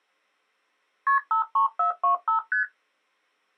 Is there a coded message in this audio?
Yes: multi-frequency trunk signalling (R1, as on North American trunks) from 1.1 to 2.6 s, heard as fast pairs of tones, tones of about 120 ms. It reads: KP 53425 ST